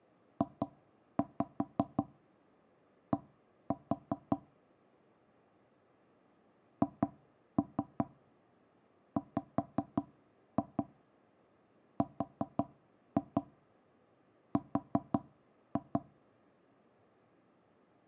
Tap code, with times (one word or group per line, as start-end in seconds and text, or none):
0.4-4.4 JD
6.8-16.0 HWRR